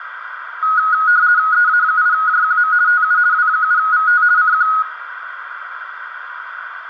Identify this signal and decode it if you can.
RTTY (50 baud, 170 Hz shift), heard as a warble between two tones, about 1360 Hz centre, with radio static, a narrow filter and room echo. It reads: EA8JQM TU W7VT CQ